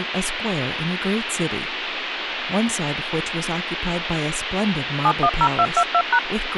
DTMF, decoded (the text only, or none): 710222#